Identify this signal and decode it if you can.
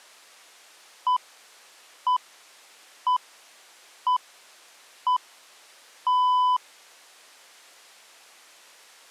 Radio time signal (six pips, as the Greenwich Time Signal), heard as pips.